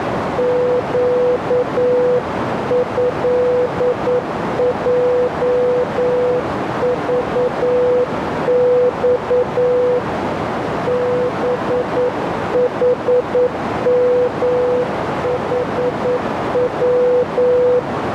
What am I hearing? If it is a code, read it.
Morse code (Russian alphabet), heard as a keyed tone, hand-sent with a paddle, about 9 wpm, 500 Hz, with heavy radio static and a narrow filter. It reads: ЩЭЙЖЬ БХМХВ